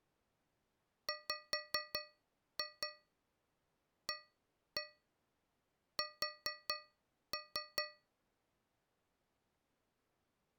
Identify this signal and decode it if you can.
Tap code, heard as taps on a metal pipe, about 4 knocks a second. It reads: WAS